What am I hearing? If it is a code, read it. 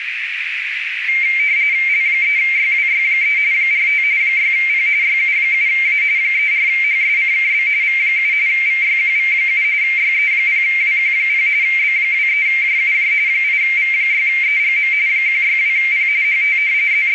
RTTY (45.45 baud, 170 Hz shift), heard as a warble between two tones, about 2200 Hz centre, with radio static and a narrow filter. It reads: L3YWY3 45 6P YU7A 34HSCKB V7 VYQV7 YE0WQ0 B23JUJ 8V6EGM 162P HT …